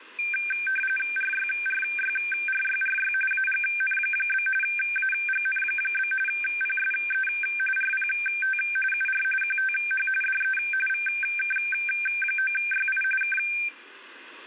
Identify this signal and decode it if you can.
RTTY (45.45 baud, 850 Hz shift), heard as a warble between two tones, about 2000 Hz centre, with radio static. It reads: RYRYRYRY AGN? AGN? PSE RPT UR QTH DE VK9YI K